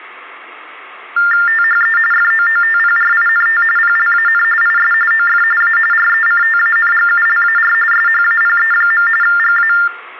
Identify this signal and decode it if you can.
TTY/TDD text telephone tones (45.45 baud Baudot), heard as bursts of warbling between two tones, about 400 Hz shift, 1600 Hz centre, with room echo. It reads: THE FOOTPRINT PLAN IS OF A RECTANGULAR SHAPE. GA